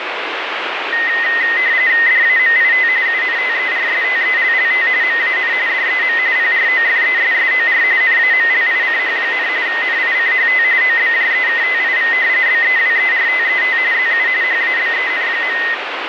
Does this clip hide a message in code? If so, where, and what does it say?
Yes: RTTY (45.45 baud, 170 Hz shift) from 0.9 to 15.7 s, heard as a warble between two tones, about 1950 Hz centre, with radio static. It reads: DAMIT UNTERSTELLT MAN DEM PROFESSOR NAMLICH, NICHT OBJEKTIV BEWERTET ZU HABEN.